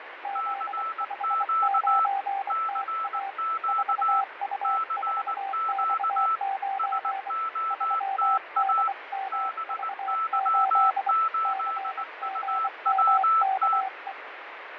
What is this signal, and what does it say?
Morse code, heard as two keyed tones, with radio static and fading. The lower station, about 24 wpm, 780 Hz: Z59TA 4U4X9 3DMV8 CGMKE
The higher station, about 19 wpm, 1320 Hz: CQ CQ CQ SOTA BY8UWT